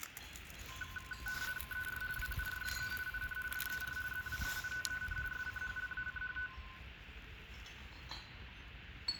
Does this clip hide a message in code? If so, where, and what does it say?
Yes: RTTY (50 baud, 450 Hz shift) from 0.7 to 6.7 s, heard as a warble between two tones, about 1270 Hz centre, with radio static, room echo and the noise of a park. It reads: ER WURDE IN DER ZWEITEN SCHLACHT